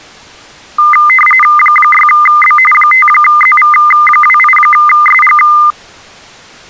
RTTY (45.45 baud, 850 Hz shift), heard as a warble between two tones, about 1650 Hz centre. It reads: 6B 5ZV28SG